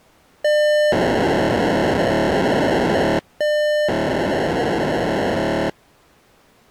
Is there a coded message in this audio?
Yes: POCSAG pager data (1200 baud) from 0.4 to 5.7 s, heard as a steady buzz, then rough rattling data.